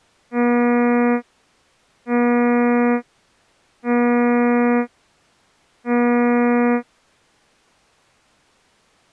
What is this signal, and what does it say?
Ship horn signal, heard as a ship's horn, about 240 Hz. 4 short. At sea: a pilot vessel's identity signal in fog.